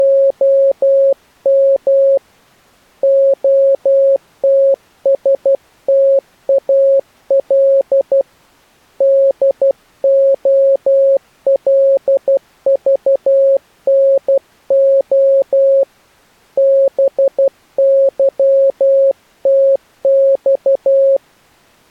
Morse code (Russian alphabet), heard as a keyed tone, hand-sent with a paddle, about 12 wpm, 540 Hz. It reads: … ОТСТАЛ ДОЛЖНО БЫТЬ